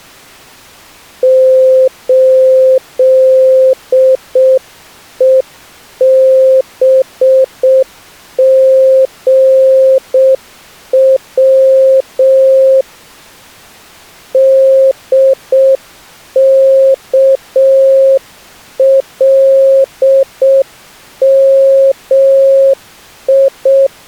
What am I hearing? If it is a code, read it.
Morse code, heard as a keyed tone, hand-sent with a straight key, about 6 wpm, 530 Hz. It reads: 8EBGW DKLMI